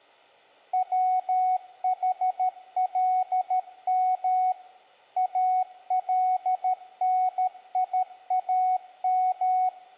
Morse code (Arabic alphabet), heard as a keyed tone, machine-sent, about 13 wpm, 740 Hz, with room echo. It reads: وحلم النيام